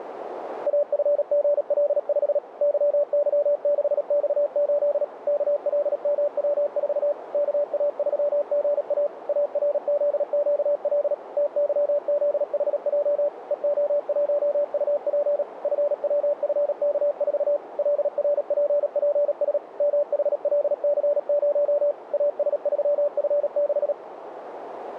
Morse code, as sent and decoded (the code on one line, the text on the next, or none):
.- ..-. --. .-.. ..... / -.-- -.-- -.... -..- ---.. / -.- .-.. -- .-- ....- / -.- .- ...-- --. .- / .- .-. --.. --.- .-.. / - -.-- --.. .... .--- / . --- .---- ..- .--. / ..-. .-- ..-. -.- ....- / .-.. .-. .--. .--. ... / -- .... .-.. -.-. ----- / .- ... ...-- ..-. -....
AFGL5 YY6X8 KLMW4 KA3GA ARZQL TYZHJ EO1UP FWFK4 LRPPS MHLC0 AS3F6